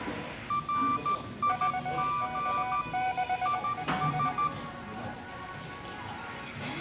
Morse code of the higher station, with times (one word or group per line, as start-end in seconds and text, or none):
0.5-2.8 RIG
3.5-4.5 IS